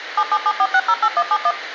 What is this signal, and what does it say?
DTMF, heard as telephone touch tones, dialled by machine, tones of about 60 ms, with radio hiss. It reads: 7774608171